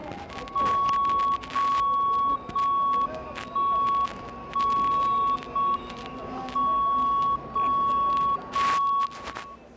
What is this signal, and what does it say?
Radio time signal (JJY), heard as a tone whose level steps once a second, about 1110 Hz, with the noise of a subway station. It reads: 0 0 1 1 0 M 0 0 1